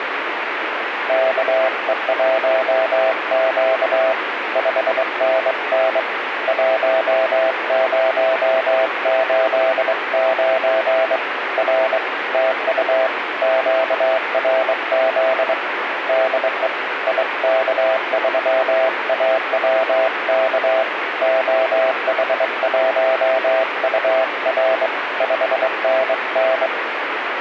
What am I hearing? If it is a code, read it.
Morse code, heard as a keyed tone, hand-sent with a straight key, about 23 wpm, 660 Hz, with radio static. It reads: KE1Q 5NN 1089 R TU QRZ DE IK3AWK OH1UR 5NN